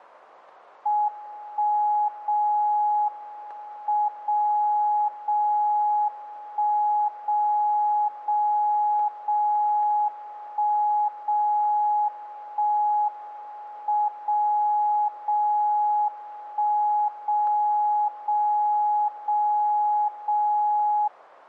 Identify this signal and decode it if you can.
Radio time signal (WWVB), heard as a tone whose level steps once a second, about 840 Hz. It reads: 1 0 M 0 0 1 0 0 0 1 0 1 M 0 0 1 0 0 0 0